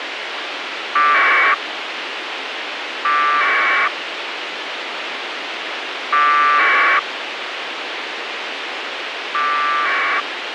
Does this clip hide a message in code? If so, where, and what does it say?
Yes: packet radio (AX.25, as in APRS), 1200 baud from 1.0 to 10.2 s, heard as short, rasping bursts, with radio hiss and a squelch burst at the end.